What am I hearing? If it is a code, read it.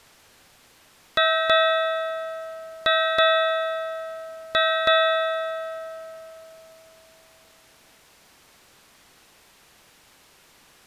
Ship's bell, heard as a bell. 6. Six half-hours of the watch have passed.